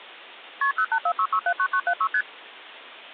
Multi-frequency trunk signalling (R1, as on North American trunks), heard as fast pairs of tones, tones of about 70 ms. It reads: KP 0846679976 ST